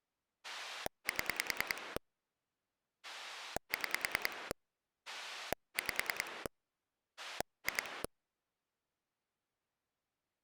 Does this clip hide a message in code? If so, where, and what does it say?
Yes: pulse dialling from 0.4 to 8.1 s, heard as a rotary dial, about 10 pulses a second. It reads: 7 6 5 2